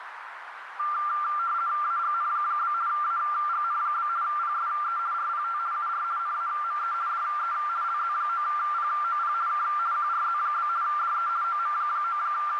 RTTY (50 baud, 170 Hz shift), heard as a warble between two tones, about 1280 Hz centre, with radio static and a narrow filter. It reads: AGN? AGN? PSE RPT UR NAME DE LZ9POP K QRZ? DE …